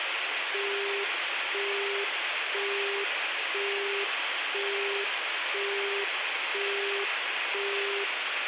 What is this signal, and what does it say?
Telephone call progress tone (single-tone plan, as in Europe, Japan and elsewhere), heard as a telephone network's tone, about 400 Hz, 0.5 s on and 0.5 s off, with phone line noise and room echo. Busy tone.